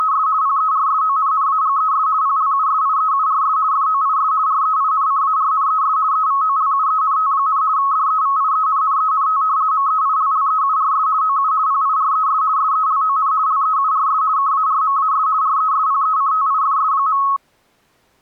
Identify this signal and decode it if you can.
RTTY (50 baud, 170 Hz shift), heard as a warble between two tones, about 1190 Hz centre. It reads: … PERSONNAGES PLUSIEURS FOIS REINCARNES EVOLUENT, DEVIENNENT MEILLEURS OU PIRES SELON LEURS KARMAS RESPECTIFS.